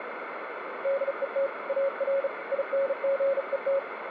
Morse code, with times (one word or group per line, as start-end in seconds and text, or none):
0.8-1.5 DET
1.7-2.3 AR
2.5-3.8 INGET